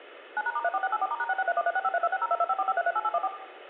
DTMF, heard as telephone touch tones, dialled by machine, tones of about 40 ms, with room echo. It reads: 9#*34684*#6631365326022545338814